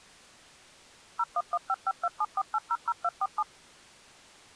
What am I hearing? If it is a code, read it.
DTMF, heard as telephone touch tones, dialled by machine, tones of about 50 ms. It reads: 01155274800247